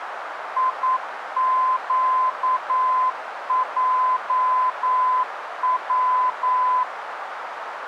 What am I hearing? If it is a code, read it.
Morse code, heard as a keyed tone, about 9 wpm, 1020 Hz, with radio static and a narrow filter. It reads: IQJW